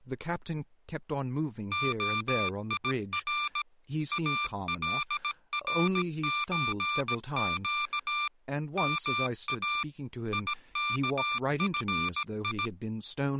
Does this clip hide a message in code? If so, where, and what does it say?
Yes: Morse code (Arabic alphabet) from 1.7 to 12.7 s, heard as electronic beeps, machine-sent, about 17 wpm, 1180 Hz, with speech in English. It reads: خير الرزق ما يكفي